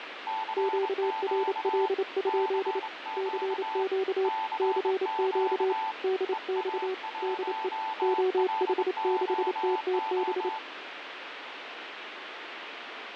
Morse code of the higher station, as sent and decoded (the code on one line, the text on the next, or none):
-.-. --.- / -.-. --.- / -.-. --.- / . .- .---- .-.. --- ---
CQ CQ CQ EA1LOO